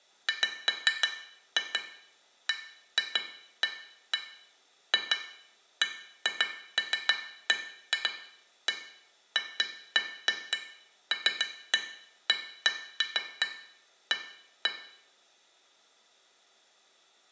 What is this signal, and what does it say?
Irregular taps on glass, with room echo. There is no code.